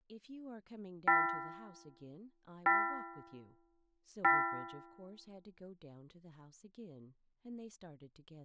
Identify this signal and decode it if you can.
Clock strike, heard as a bell, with room echo and speech in English. 3. Three o'clock.